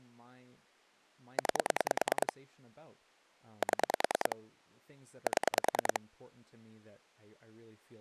Pulse dialling, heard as clicks on a phone line, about 10 pulses a second, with speech in English. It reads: 9 7 7